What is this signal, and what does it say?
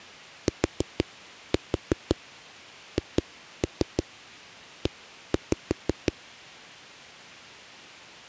Tap code, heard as knocks on a wall, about 6 knocks a second. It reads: THE